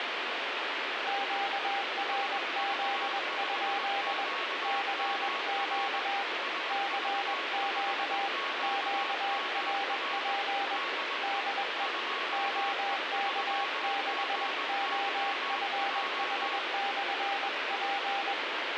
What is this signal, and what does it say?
Morse code, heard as two keyed tones, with heavy radio static. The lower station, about 21 wpm, 800 Hz: QRZ? CQ CQ QRP DE OK6OFH/P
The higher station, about 20 wpm, 1110 Hz: SV5QMR SV5QMR DE 2E3GYJ